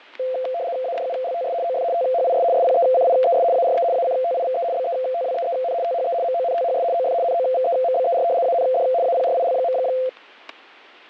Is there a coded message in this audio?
Yes: RTTY (75 baud, 170 Hz shift) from 0.2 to 10.1 s, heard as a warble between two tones, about 600 Hz centre, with fading and static crashes. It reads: ADULTS OF THIS SPECIES ARE ACTIVE BETWEEN THE MONTHS OF NOVEMBER AND APRIL.